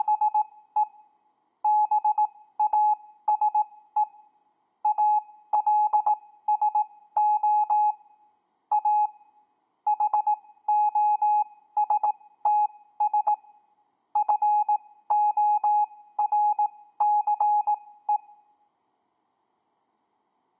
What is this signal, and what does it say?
Morse code, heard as a keyed tone, machine-sent, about 18 wpm, spaced as for 14 wpm, 840 Hz. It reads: … BASE ALSO A HOSTS FORCE